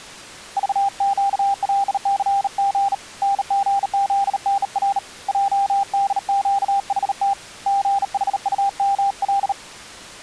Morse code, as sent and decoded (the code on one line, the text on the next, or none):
...- --.- .-.. -.-. --. / -. --. --.. -. .-. / .--- -.. --.- .... - / --. .... ..- -- .-..
VQLCG NGZNR JDQHT GHUML